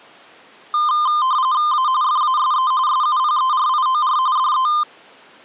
RTTY (45.45 baud, 170 Hz shift), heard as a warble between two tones, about 1120 Hz centre. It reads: A FASE SUPERIOR DE